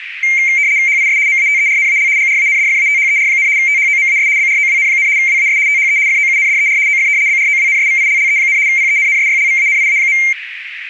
RTTY (75 baud, 170 Hz shift), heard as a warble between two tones, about 2200 Hz centre, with radio static and a narrow filter. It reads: HIS MATERNAL GRANDFATHER, THOMAS BROWN, WAS THE FOUNDER OF BROWNSVILLE, PENNSYLVANIA.